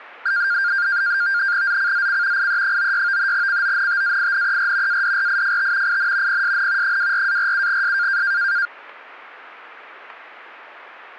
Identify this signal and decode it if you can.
NAVTEX (SITOR-B), 100 baud, 170 Hz shift, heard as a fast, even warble, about 1500 Hz centre. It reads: ZCZC IE96 CONTAINER ADRIFT IN PSN 24-47S